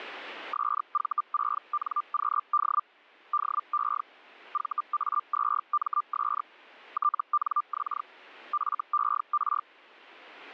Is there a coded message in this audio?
Yes: Hellschreiber (Feld-Hell, 122.5 baud) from 0.5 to 9.6 s, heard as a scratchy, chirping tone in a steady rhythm, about 1190 Hz. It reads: SV6NQD DE VA2MS TNX FER